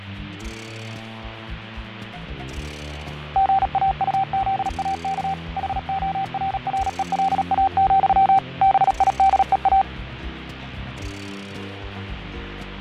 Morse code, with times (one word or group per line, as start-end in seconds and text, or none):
3.4-5.3 GAUZAK
5.6-8.4 HORRELA,
8.6-9.8 BIDEA